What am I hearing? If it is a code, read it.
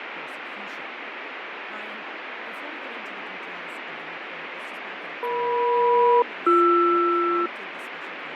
Aircraft SELCAL, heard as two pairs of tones, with radio static, fading and speech in English. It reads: EM-BR